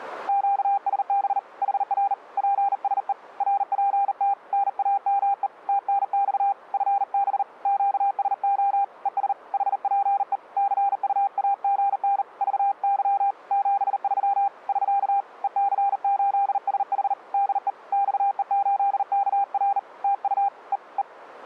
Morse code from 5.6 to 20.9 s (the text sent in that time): TNX FB QSO ES HPE CUAGN VY 73 <SK> EC8SH DE XE8KR TU E